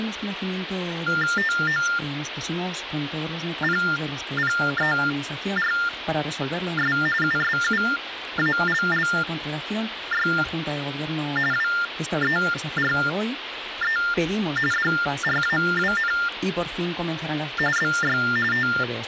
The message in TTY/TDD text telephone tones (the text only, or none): TOPPERS USUALLY WERE DRAWN BY …